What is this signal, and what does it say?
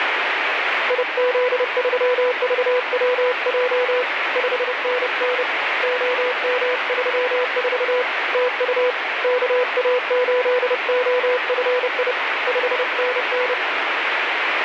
Morse code, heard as a keyed tone, hand-sent with a paddle, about 30 wpm, 500 Hz, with heavy radio static. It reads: IZ3VWJ 5NN OM34 TU KA8OFI 5NN